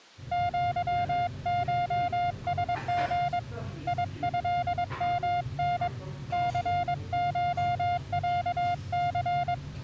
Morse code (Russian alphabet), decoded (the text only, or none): ЪШСГ ИЭМН ЦШЯЦ